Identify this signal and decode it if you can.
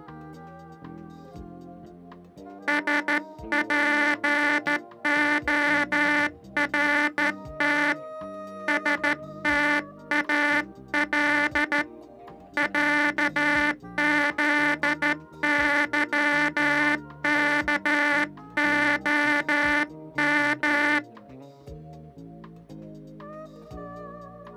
Morse code (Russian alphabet), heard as a buzzer, hand-sent with a straight key, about 13 wpm. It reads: СПОРТ СТАЛ ЯЗЫКОМ